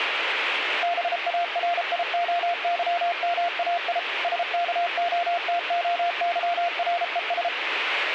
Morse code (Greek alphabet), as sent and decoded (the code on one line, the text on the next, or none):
-... .- .-. .. --- -.-- -- .- .. / ... -.- --- - --- -.-- .-. . ...
ΒΑΡΙΟΥΜΑΙ ΣΚΟΤΟΥΡΕΣ